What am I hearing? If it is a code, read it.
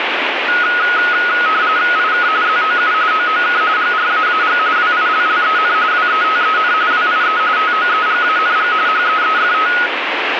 RTTY (45.45 baud, 170 Hz shift), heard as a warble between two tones, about 1360 Hz centre, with radio static. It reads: IK ZOU OOK GRAAG WILLEN WETEN WIE TOEGANG HEEFT